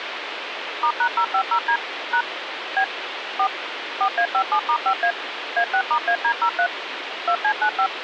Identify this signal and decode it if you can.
DTMF, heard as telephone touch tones, dialled by machine, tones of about 80 ms, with phone line noise. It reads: *#050D # B 4 4A57*5A A6*AD03 2C95